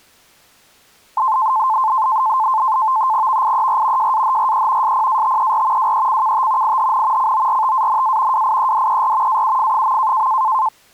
NAVTEX (SITOR-B), 100 baud, 170 Hz shift, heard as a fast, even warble, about 960 Hz centre. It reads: VIER JAHRE SPATER WECKT IHN CORTANA WIEDER AUF.